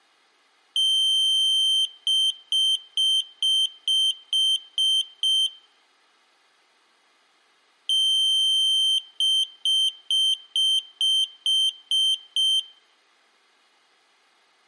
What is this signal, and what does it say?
Beep code, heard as a piezo beeper, played twice, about 3100 Hz, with room echo. 1 long, 8 short. In AMI BIOS tables: display or retrace test failure.